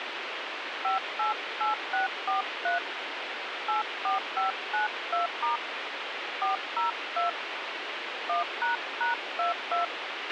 DTMF, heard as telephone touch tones, dialled by hand, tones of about 140 ms, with radio hiss and a squelch burst at the end. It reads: 588643 84592* 402 1##22